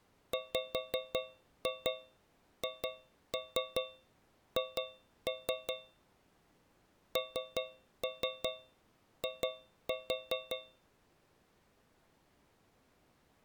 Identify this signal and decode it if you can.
Tap code, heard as taps on a metal pipe, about 5 knocks a second. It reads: WHH NI